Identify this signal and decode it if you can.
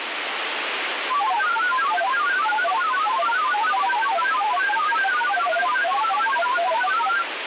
Multi-tone FSK (Olivia or MFSK type), about 1000 Hz wide, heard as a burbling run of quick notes, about 31.25 baud, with radio static.